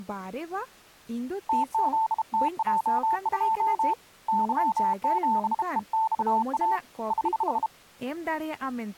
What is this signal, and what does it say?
Morse code, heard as a keyed tone, hand-sent with a bug key, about 32 wpm, 890 Hz, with speech in Santali. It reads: TZTJ2 Y7EXA <HH>